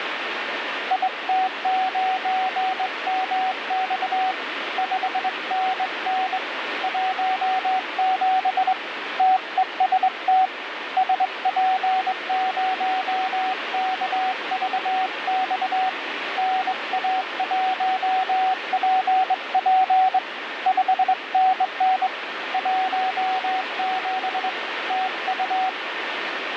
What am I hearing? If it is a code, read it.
Morse code, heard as a keyed tone, hand-sent with a straight key, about 22 wpm, 750 Hz, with radio static. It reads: IT9MX 5NN 17 TEST SP0KVX NA1PP 5NN 17 TU